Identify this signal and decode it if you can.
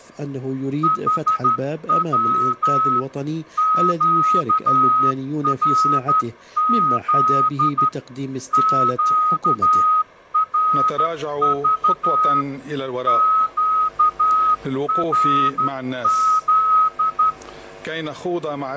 Morse code, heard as a whistle, hand-sent with a straight key, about 12 wpm. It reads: HW QRZ QRV QRZ